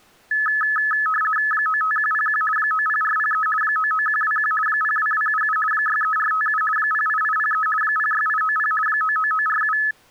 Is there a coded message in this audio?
Yes: RTTY (50 baud, 450 Hz shift) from 0.3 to 9.9 s, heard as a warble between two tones, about 1500 Hz centre. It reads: 95101 90403 99121 02277 63457 08803 06890 99947